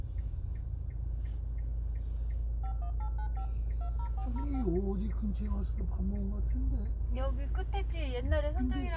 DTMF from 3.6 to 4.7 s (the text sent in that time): 20405